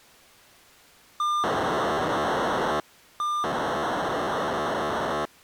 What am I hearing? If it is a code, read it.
POCSAG pager data (2400 baud), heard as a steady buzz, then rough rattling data.